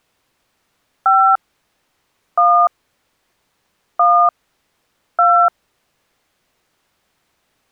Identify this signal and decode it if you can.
DTMF, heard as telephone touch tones, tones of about 300 ms. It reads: 5 1 1 2